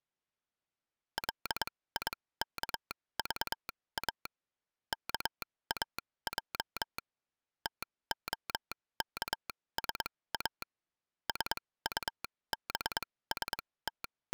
Morse code, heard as a telegraph sounder, machine-sent, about 22 wpm, spaced as for 17 wpm. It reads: LIKVA KAJ TOKSA …